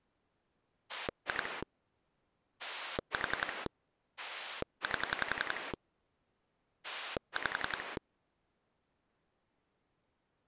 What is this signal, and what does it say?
Pulse dialling, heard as a rotary dial, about 11 pulses a second. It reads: 2 4 8 5